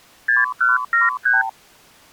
Multi-frequency trunk signalling (R2, with the far end's replies), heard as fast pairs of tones, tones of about 160 ms. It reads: 6173